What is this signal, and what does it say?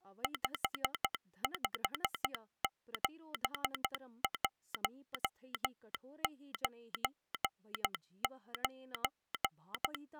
Morse code, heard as a telegraph sounder, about 12 wpm, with speech in Sanskrit. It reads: 557199